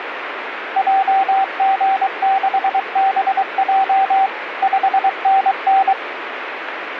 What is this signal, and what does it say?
Morse code, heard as a keyed tone, machine-sent, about 23 wpm, 770 Hz, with radio static. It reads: JG6BJ 5NN